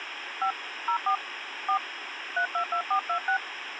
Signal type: DTMF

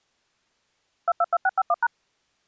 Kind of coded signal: DTMF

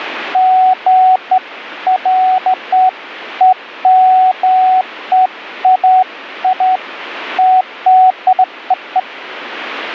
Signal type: none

